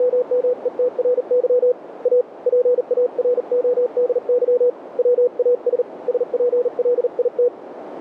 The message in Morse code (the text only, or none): … A PARODY WAS SPLIT